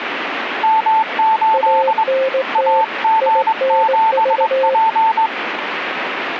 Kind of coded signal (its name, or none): Morse code